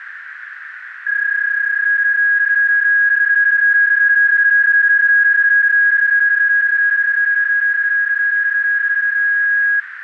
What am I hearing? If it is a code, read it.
PSK31 (31.25 baud), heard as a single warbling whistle, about 1650 Hz, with radio static and a narrow filter.